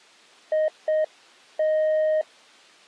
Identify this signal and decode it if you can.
Morse code, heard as a keyed tone, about 7 wpm, 620 Hz. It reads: IT